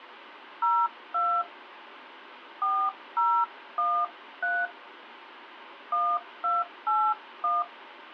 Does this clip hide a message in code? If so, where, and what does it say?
Yes: DTMF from 0.6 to 7.6 s, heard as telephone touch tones, dialled by hand, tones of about 240 ms, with phone line noise. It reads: 02 4013 1281